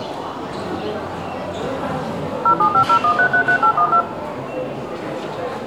DTMF, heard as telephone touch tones, dialled by machine, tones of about 90 ms, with room echo and the noise of a crowd indoors. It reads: 07501333812